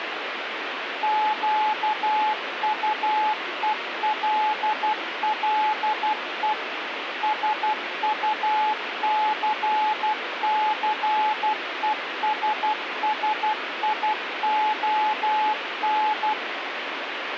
Morse code, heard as a keyed tone, machine-sent, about 12 wpm, 860 Hz, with radio static. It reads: QUELLE SUCCESSION